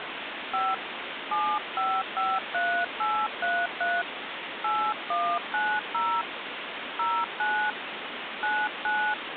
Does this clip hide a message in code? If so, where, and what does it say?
Yes: DTMF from 0.5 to 9.1 s, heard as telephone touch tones, dialled by hand, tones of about 260 ms, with phone line noise. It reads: 5 7553833 8190 09 99